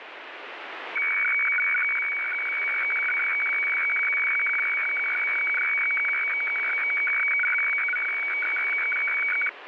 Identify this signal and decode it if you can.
Weather fax (radiofax), 120 lines a minute, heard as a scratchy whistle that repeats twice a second, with radio static.